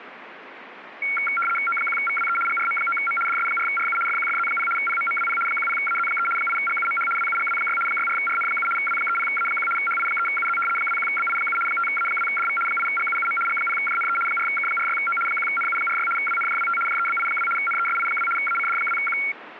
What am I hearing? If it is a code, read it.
RTTY (75 baud, 850 Hz shift), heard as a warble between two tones, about 1800 Hz centre, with radio static. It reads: O1VWE GRM9M DS4RU FQFZ0 PMMWP 10AZ3 8GUMH WUGW6 64RN7 W30A1 HI3UZ 21BI7 5A2DV 8GUUM G0JNE 4K46O 1NU46 WNJWT JEBI2 NESI2 ACD2Q